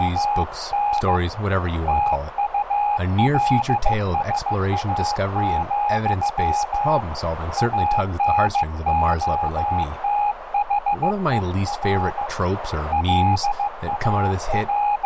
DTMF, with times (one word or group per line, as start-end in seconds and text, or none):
none